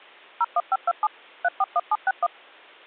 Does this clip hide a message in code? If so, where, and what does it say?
Yes: DTMF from 0.4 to 2.3 s, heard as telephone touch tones, dialled by machine, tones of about 40 ms. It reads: 01527 341761